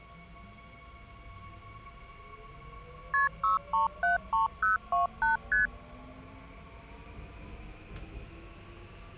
Multi-frequency trunk signalling (R1, as on North American trunks), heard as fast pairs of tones, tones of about 140 ms, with the noise inside a subway train. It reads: KP 6373028 ST